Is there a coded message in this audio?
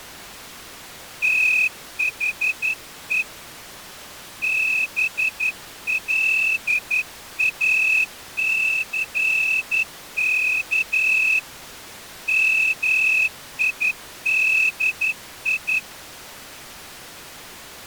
Yes: Morse code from 1.2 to 15.8 s, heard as a whistle, hand-sent with a straight key, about 11 wpm. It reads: THE BLACK MIDI